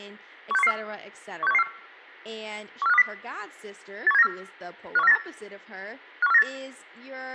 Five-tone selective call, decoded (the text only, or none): 16114 16114 14520 81794 51498 51498